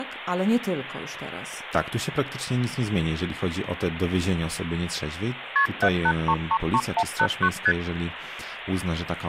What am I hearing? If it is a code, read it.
Multi-frequency trunk signalling (R1, as on North American trunks), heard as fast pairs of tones, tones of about 60 ms, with phone line noise. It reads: KP 78333189 ST